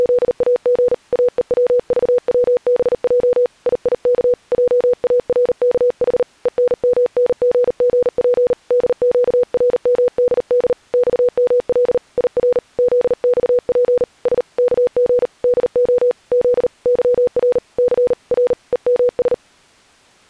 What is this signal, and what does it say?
Morse code, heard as a keyed tone, hand-sent with a paddle, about 39 wpm, 490 Hz. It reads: … AEWVWBJ IIK JARKH ENMNGGP DQRMDD XML IR ZXP S KG DO Z YR C R EMS